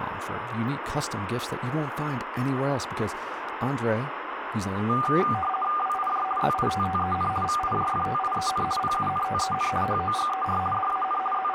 RTTY (50 baud, 450 Hz shift), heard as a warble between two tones, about 980 Hz centre, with radio static and speech in English. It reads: WIJ ZITTEN VIJFTIEN PUNTEN HOGER DAN …